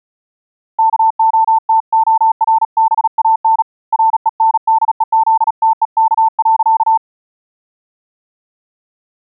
Morse code, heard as a keyed tone, hand-sent with a paddle, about 37 wpm, 890 Hz. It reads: KOTORBAN RENDEZTEK.